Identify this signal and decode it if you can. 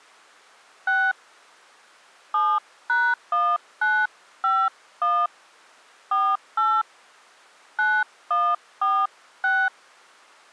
DTMF, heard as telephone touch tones, dialled by hand, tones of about 240 ms. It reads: 6 7#1951 48 9146